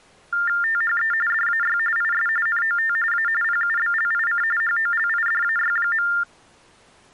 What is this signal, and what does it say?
TTY/TDD text telephone tones (45.45 baud Baudot), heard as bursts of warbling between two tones, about 400 Hz shift, 1600 Hz centre. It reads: THE DAY IS NOT A PUBLIC HOLIDAY.